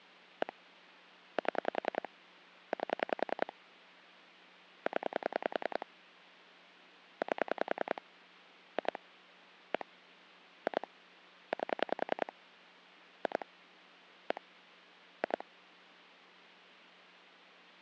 Pulse dialling, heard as clicks on a phone line, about 10 pulses a second. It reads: 1 7 8 0 8 2 1 2 8 2 1 2